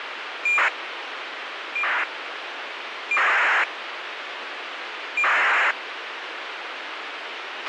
ACARS aircraft data, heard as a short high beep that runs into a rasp, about 2400 baud, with radio hiss and a squelch burst at the end.